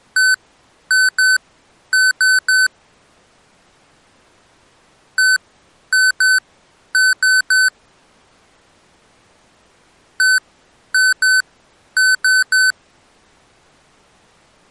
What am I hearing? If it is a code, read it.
Beep code, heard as beeps from a small speaker, played three times, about 1500 Hz. 1-2-3. In Phoenix BIOS tables: DMA page register failure.